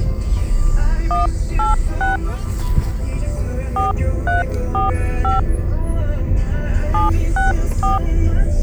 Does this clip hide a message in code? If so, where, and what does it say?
Yes: DTMF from 1.1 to 8.0 s, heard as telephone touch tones, dialled by hand, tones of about 150 ms, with the noise inside a car. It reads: 186 4345 764